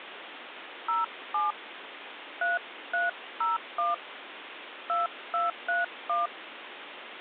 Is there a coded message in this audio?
Yes: DTMF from 0.9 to 6.3 s, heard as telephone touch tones, dialled by hand, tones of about 160 ms, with phone line noise. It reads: 07 3301 2231